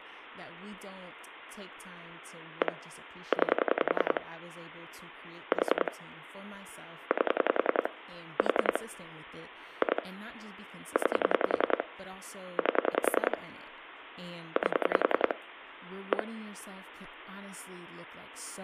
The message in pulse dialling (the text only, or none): 1 9 4 8 4 2 9 8 8 1